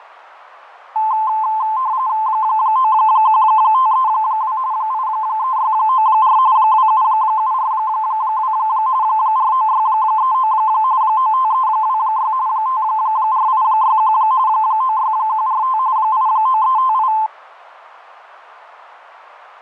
RTTY (45.45 baud, 170 Hz shift), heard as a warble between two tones, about 960 Hz centre. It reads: 91532 83694 27742 49639 95326 54861 96145 89358